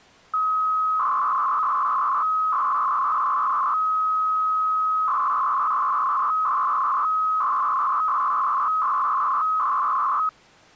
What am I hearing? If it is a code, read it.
300-baud modem data (Bell 103 tones), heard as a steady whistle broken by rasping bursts, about 300 baud, 200 Hz shift.